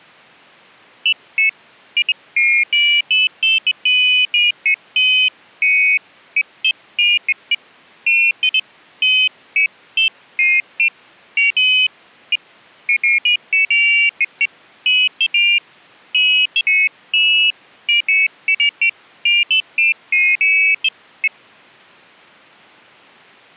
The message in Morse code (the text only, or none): none